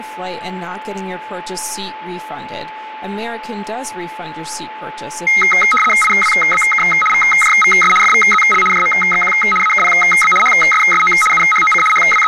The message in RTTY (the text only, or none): IWBK VJVS FVZL JMXQ AKPB HSSO UHOC …